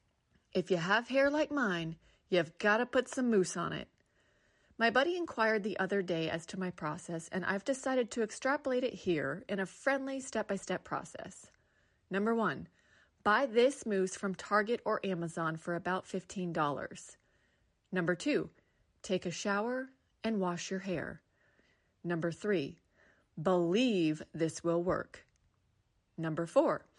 Speech in English. There is no code.